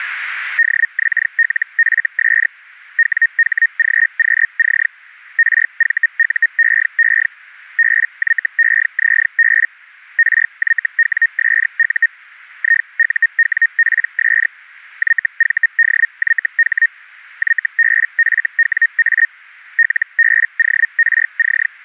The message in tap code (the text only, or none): none